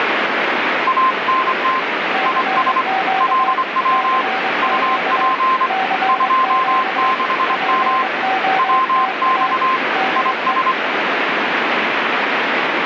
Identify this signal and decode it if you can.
Morse code, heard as two keyed tones, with radio static. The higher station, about 25 wpm, 1040 Hz: ANT IS LW UP 26M WX IS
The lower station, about 22 wpm, 760 Hz: CQ CQ CQ POTA DE